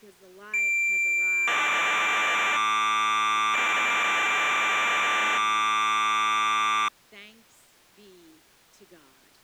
Cassette data (Kansas City type), 1200 baud, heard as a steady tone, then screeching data.